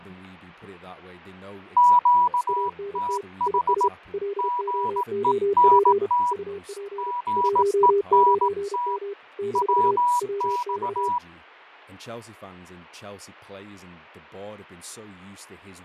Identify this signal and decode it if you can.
Morse code, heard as two keyed tones, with radio static, fading and speech in English. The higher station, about 18 wpm, 980 Hz: QTH GENT GENT WX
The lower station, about 32 wpm, 400 Hz: ANT IS LOOP UP 19M - WX